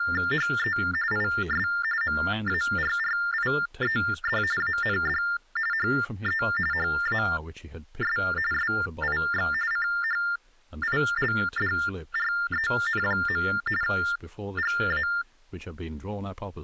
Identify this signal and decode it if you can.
TTY/TDD text telephone tones (45.45 baud Baudot), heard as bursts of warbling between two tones, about 400 Hz shift, 1600 Hz centre, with speech in English. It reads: HE IS MARRIED AND HE HAS SIX CHILDREN. GA